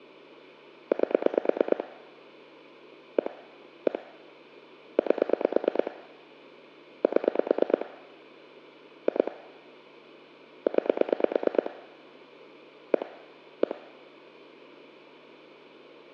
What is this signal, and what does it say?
Pulse dialling, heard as clicks on a phone line, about 9 pulses a second, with hum and room echo. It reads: 8 1 1 8 7 2 9 1 1